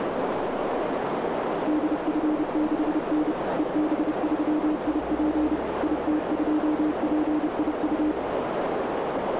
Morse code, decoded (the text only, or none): DF6N EB3IP IT2PIU